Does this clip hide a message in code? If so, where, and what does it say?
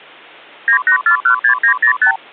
Yes: multi-frequency trunk signalling (R2, with the far end's replies) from 0.7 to 2.2 s, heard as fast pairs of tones, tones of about 100 ms. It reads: 98416905